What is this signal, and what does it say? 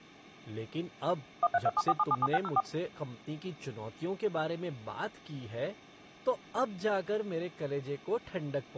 DTMF, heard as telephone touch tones, dialled by machine, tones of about 40 ms, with speech in Hindi. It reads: 13274777604